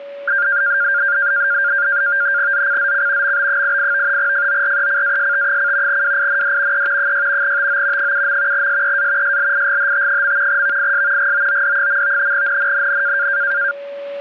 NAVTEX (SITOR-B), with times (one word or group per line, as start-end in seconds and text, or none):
2.5-3.4 ZCZC
3.2-4.2 MB88
4.2-6.0 FORECAST:
5.9-6.9 WIND
6.7-7.1 E
7.0-7.6 6
7.4-8.1 TO
8.0-8.7 7.
8.5-9.4 SEA
9.2-10.6 SLIGHT.
10.5-11.3 VIS
11.2-12.3 GOOD.
12.3-13.3 NNNN